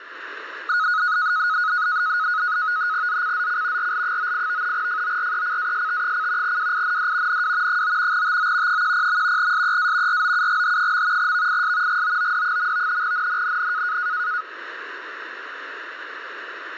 NAVTEX (SITOR-B), 100 baud, 170 Hz shift, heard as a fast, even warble, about 1360 Hz centre, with radio static. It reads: ZCZC RL98 FORECAST: WIND NW 9 TO 10. SEA ROUGH. VIS GOOD. NNNN